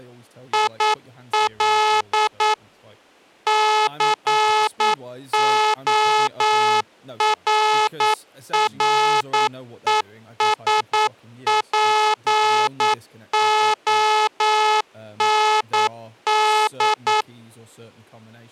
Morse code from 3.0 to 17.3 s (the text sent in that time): CORRESPOND